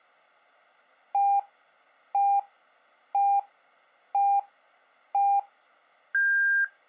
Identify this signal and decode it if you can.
Radio time signal (five pips and a higher one, as on Chinese radio), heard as pips.